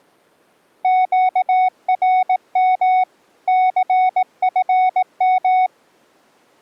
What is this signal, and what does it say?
Morse code, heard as a keyed tone, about 18 wpm, 740 Hz. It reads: QRM CFM